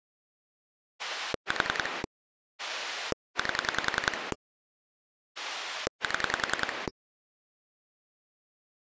Pulse dialling, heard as a rotary dial, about 10 pulses a second. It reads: 4 8 7